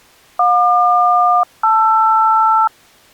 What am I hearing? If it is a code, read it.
Aircraft SELCAL, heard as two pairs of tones. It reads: JQ-LR